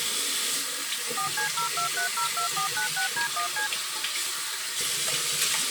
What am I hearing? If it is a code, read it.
DTMF, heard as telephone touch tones, dialled by machine, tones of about 110 ms, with the noise of a restroom. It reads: 4C02302496D1C